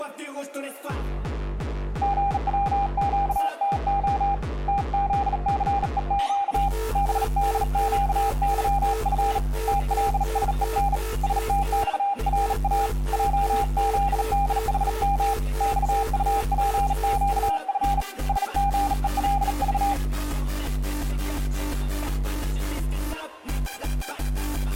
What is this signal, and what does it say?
Morse code, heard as a keyed tone, hand-sent with a bug key, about 38 wpm, 800 Hz. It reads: GWQTO TZCEQ BDQYF TLSEN STXRA JZDHM XUPQF SGELV